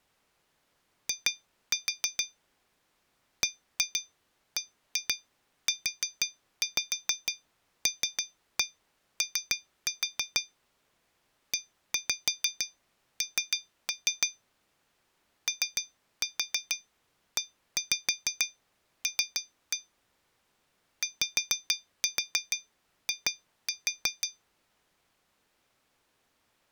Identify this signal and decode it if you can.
Tap code, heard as taps on glass, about 6 knocks a second. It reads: I BBULO EN OEL YI